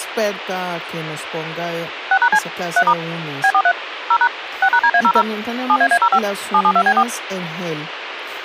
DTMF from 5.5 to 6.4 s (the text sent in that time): 7AA05